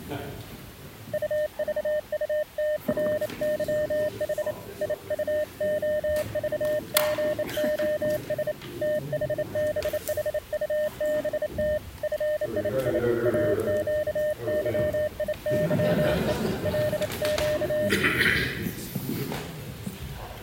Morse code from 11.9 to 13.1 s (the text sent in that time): FII